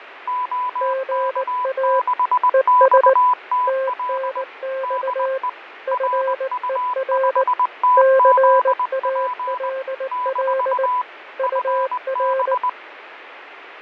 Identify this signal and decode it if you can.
Morse code, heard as two keyed tones, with radio static and fading. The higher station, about 20 wpm, 1000 Hz: OK6XTL DE RU5TZP - FB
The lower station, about 19 wpm, 530 Hz: GA ES TNX FER CALL UR